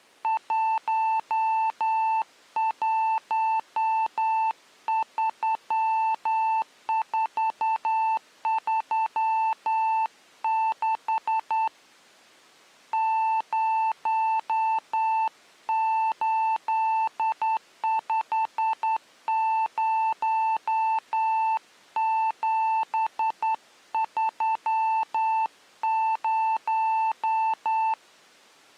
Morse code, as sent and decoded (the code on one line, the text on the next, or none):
.---- .---- ...-- ....- ...-- -.... / ----- ---.. ..... ----- --... ...-- -----
113436 0850730